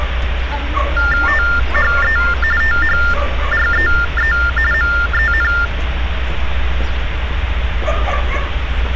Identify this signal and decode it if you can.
TTY/TDD text telephone tones (45.45 baud Baudot), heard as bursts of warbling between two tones, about 400 Hz shift, 1600 Hz centre, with phone line noise and street noise. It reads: THE THREE MEN